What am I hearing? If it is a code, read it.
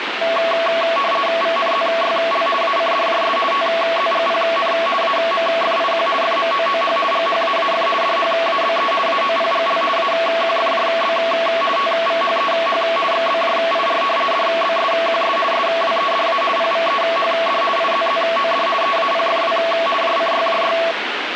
RTTY (50 baud, 450 Hz shift), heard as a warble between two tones, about 890 Hz centre, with radio static. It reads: VNZYL ACDJS TZGPN AMFIQ FMOOH GHAAF DHABE AOPGL AQFJB TVHEH XBJIR DBSQS SWEDA PVEHD IZZOD EAPFW JCYJY